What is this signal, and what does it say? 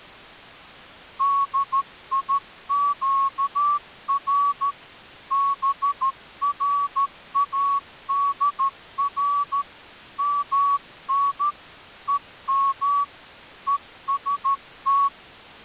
Morse code (Persian alphabet), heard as a whistle, hand-sent with a straight key, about 13 wpm. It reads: دیگر برادر من هم هست